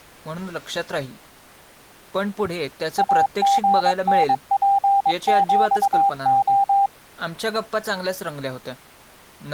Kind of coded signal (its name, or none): Morse code